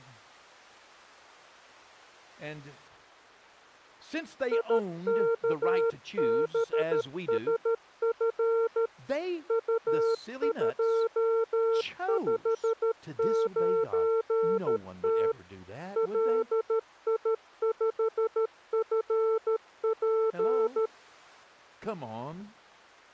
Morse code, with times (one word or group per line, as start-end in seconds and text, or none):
4.5-8.9 IKBSF
9.5-15.3 U259T
16.0-20.9 LI5FP